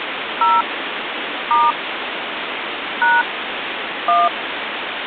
DTMF, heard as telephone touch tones, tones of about 200 ms, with phone line noise. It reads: 0 * # 1